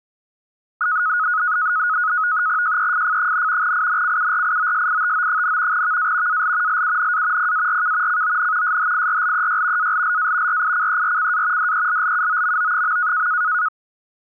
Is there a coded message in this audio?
Yes: NAVTEX (SITOR-B), 100 baud, 170 Hz shift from 0.8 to 13.7 s, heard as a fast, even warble, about 1360 Hz centre. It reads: JEFF, INCURIOSITO, VA AL LUNA PARK CON SHIRLEY ALLA RICERCA DELLUOMO.